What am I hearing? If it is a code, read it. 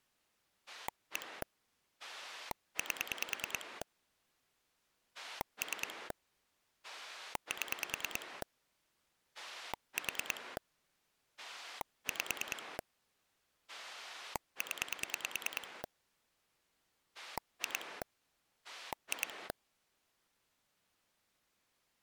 Pulse dialling, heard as a rotary dial, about 9 pulses a second. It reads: 1 8 3 7 4 5 0 2 2